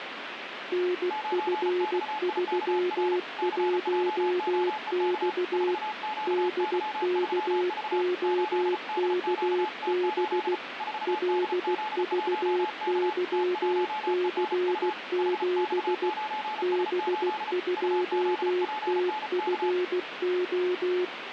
Morse code, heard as two keyed tones, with radio static. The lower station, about 16 wpm, 360 Hz: NF31X DKOKB LVYC7 B2TFO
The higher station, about 34 wpm, 860 Hz: 9XIKR CJOEK 4QY3V 8DQT8 4DZ1K T1ENU HX9S8 UZPNK